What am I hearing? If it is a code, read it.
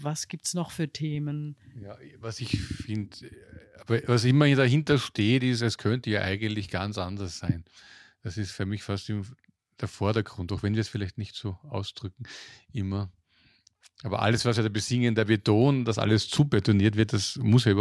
Speech in German. There is no code.